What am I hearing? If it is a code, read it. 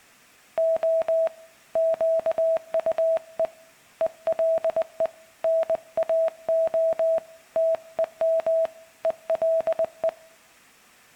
Morse code, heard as a keyed tone, hand-sent with a paddle, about 20 wpm, 650 Hz. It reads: O QUE ELE NAO TEM ELE